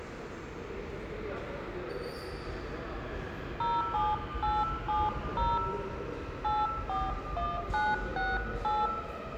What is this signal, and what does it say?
DTMF, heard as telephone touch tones, dialled by hand, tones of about 210 ms, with room echo and the noise of a subway station. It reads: 07870 841968